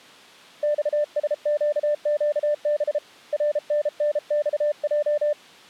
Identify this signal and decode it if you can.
Morse code (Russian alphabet), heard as a keyed tone, hand-sent with a paddle, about 33 wpm, 590 Hz. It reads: ЬСЩЩБ РННЬЙ